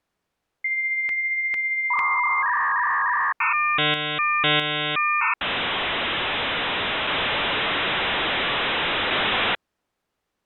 Dial-up modem handshake (V.34 or later), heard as a whistle, warbles, then hiss.